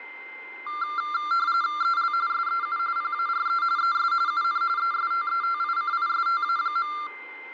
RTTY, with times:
1.8-2.1 EL
2.3-2.8 SEU
3.0-3.6 PARE
3.8-4.1 ES
4.3-4.6 UN
4.8-6.9 ESTETICISTA.

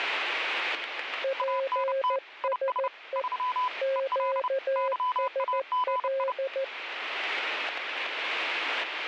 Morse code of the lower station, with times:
1.2-3.2 PSE
3.8-6.6 QSL

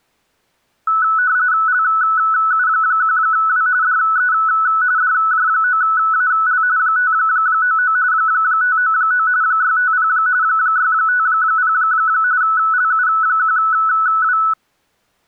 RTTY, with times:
1.7-3.7 LU1W
3.8-4.3 DE
5.0-6.6 DJ9AL
6.8-8.0 599
8.1-9.3 599
9.4-10.1 650
10.4-11.7 650
12.4-14.4 LU1W

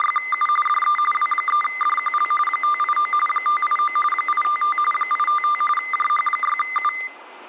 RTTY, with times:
0.0-0.5 …
0.7-1.0 DE
1.1-2.3 W3DQL
2.5-3.1 589
3.3-4.0 589
4.1-4.8 855
4.9-5.6 855
5.8-6.9 JH6U

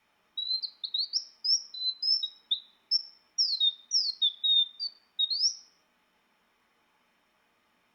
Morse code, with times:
none

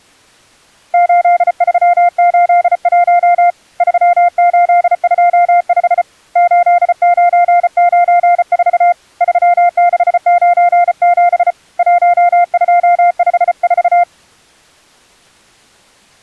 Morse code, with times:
0.9-3.5 8381
3.8-6.0 3825
6.4-8.9 8994
9.2-11.5 3697
11.8-14.0 1254

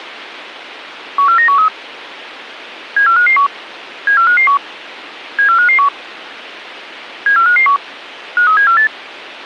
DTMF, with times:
none

